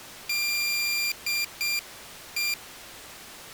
Morse code, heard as a high beeper, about 7 wpm, 2400 Hz. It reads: DE